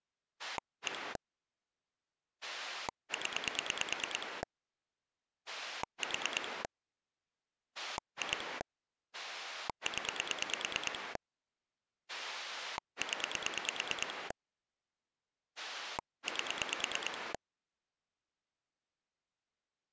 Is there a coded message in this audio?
Yes: pulse dialling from 0.4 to 17.4 s, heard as a rotary dial, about 9 pulses a second. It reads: 1 0 4 2 0 0 8